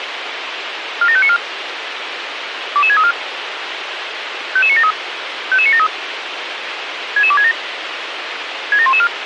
Five-tone selective call (ZVEI), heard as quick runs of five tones, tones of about 70 ms, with radio hiss. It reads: 47594 22634 55973 55973 66267 67114